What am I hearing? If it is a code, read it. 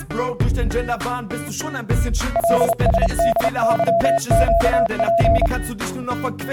Morse code, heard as a keyed tone, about 30 wpm, 680 Hz. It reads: LSDYQP